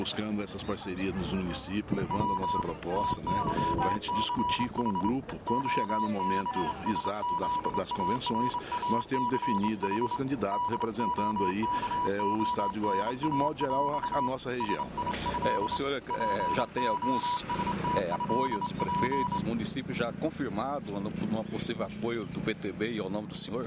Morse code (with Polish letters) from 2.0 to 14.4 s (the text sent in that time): W TYCH OBSZARACH DOKONAŁ